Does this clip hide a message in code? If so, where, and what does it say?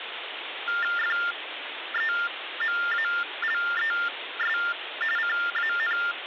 Yes: TTY/TDD text telephone tones (45.45 baud Baudot) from 0.7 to 6.1 s, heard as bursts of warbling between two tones, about 400 Hz shift, 1600 Hz centre, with phone line noise. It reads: FEMALES CAN